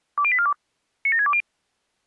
Five-tone selective call (ZVEI), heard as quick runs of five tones, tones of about 70 ms. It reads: 20842 97620